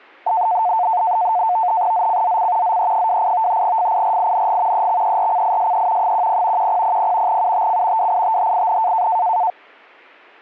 NAVTEX (SITOR-B), 100 baud, 170 Hz shift, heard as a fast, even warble, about 800 Hz centre. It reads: ZCZC ZE28 FIRING EXERCISE 10 1000 UTC WITHIN